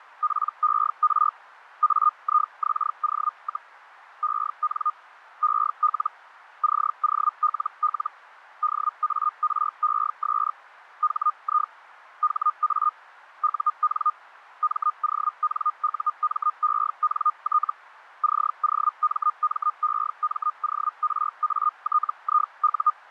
Hellschreiber (Feld-Hell, 122.5 baud), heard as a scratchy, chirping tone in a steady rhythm, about 1220 Hz. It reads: PER AIXO, EN EL COLL DARES HI HA UN MONUMENT COMMEMORATIU